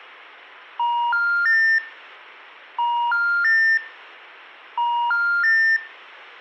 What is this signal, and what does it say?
Telephone call progress tone (ITU plan), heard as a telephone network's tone, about 950, 1400, 1800 Hz, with room echo. Special information tone.